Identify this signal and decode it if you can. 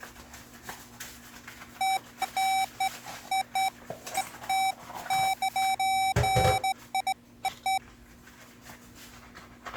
Beeps of irregular length, with kitchen noise. There is no code.